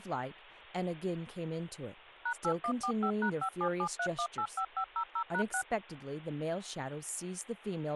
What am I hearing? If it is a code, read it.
DTMF, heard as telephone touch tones, dialled by machine, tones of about 80 ms, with speech in English. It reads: #8145#5773185500#6